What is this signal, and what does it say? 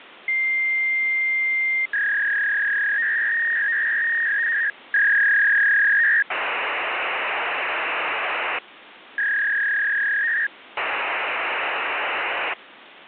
Fax machine handshake, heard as a long tone, a warble and hiss, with phone line noise.